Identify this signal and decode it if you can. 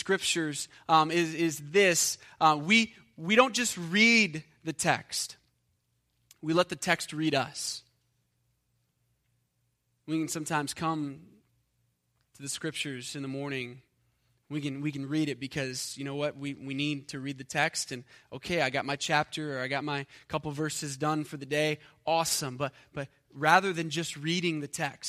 Speech in English. There is no code.